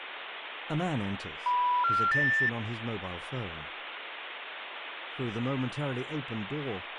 Telephone call progress tone (North American plan), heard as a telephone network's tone, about 980, 1370, 1800 Hz, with phone line noise and speech in English. Special information tone.